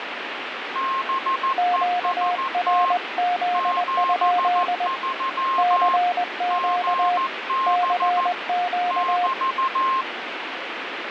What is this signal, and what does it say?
Morse code, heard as two keyed tones, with radio static. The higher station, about 14 wpm, 1060 Hz: BEST 73 GB <BT>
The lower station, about 20 wpm, 710 Hz: QRZ? CQ CQ